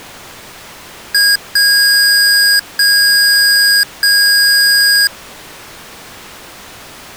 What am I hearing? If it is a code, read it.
Beep code, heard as beeps from a small speaker, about 1650 Hz. 1 short, 3 long.